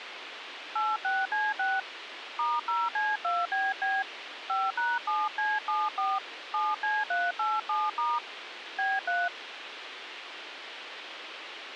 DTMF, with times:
0.8-1.8 86C6
2.4-4.0 *0C2BB
4.5-6.2 5#7C74
6.5-8.2 7C387*
8.8-9.3 B3

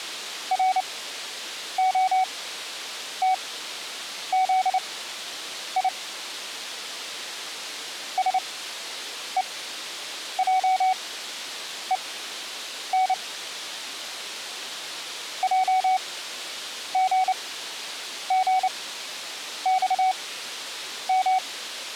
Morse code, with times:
0.5-5.9 ROTZI
8.2-13.1 SEJEN
15.4-21.4 JGGXM

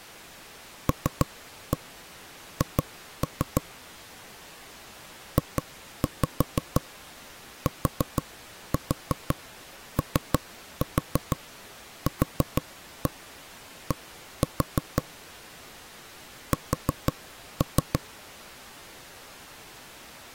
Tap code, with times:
0.9-3.6 LH
5.4-15.0 JTOQD
16.5-18.0 S

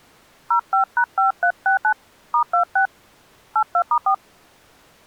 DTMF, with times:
0.5-1.9 05#5369
2.3-2.9 *26
3.6-4.1 82*4

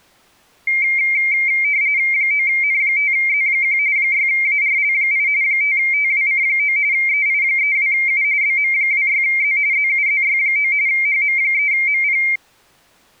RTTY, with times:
2.1-3.8 9N5Z1
4.0-5.3 6ARL8
5.4-6.8 5TWC9
6.9-8.2 EI32U
8.4-9.6 BM26Z
9.7-10.7 ZUZY9
10.9-12.2 HM3MP

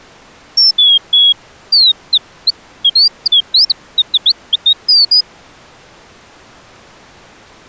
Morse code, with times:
none

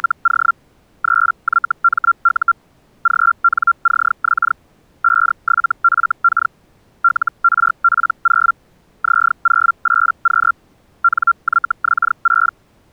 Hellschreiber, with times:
0.0-0.5 …
1.0-2.5 3YMU
3.0-4.5 GNCX
5.0-6.5 57FK
7.0-8.5 LRP0
9.0-10.5 Z08Q
11.0-12.5 NYX6

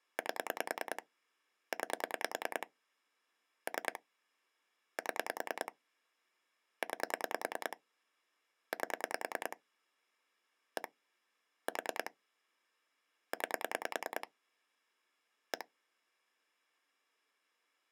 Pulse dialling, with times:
0.2-1.0 8
1.7-2.7 9
3.7-4.0 3
5.0-5.7 7
6.8-7.8 9
8.7-9.6 8
10.8-10.9 1
11.7-12.1 4
13.3-14.3 9
15.5-15.6 1

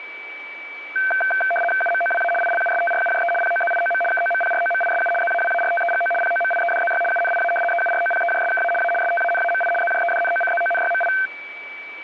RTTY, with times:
1.8-2.3 UMOWA
2.4-3.3 ILUSTRUJE
3.4-4.0 POZIOM
4.1-5.1 KOMPROMISU
5.2-6.1 ZAWARTEGO
6.2-7.0 POMIEDZY
7.1-7.5 UNIA
7.7-8.7 EUROPEJSKA
8.8-8.9 A
9.0-9.7 STANAMI
9.8-11.1 ZJEDNOCZONYMI

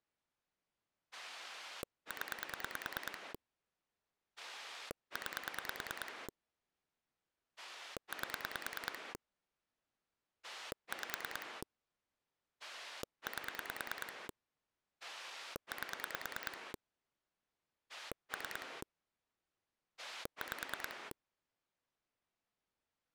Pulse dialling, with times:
1.1-3.3 0
4.4-6.3 9
7.6-9.1 8
10.4-11.6 5
12.6-14.3 8
15.0-16.7 8
17.9-18.8 3
20.0-21.1 5

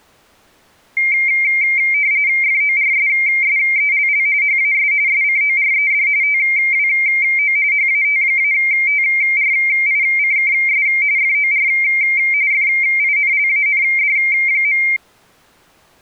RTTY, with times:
2.4-4.3 FORSSELL
4.4-4.9 HAS
5.1-6.1 SCORED
6.2-7.6 TWO
7.7-10.9 HAT-TRICKS
11.2-11.7 FOR
12.5-14.8 FINLAND.

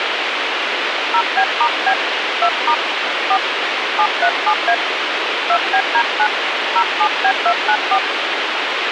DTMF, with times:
1.1-1.9 0B*B
2.4-2.7 2*
3.3-3.4 4
4.0-4.7 737A
5.5-6.3 2BD9
6.8-8.0 07B294

